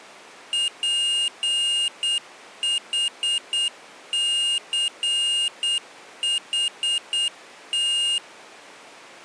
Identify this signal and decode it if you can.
Morse code, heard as a high beeper, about 8 wpm, 2850 Hz. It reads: PHCHT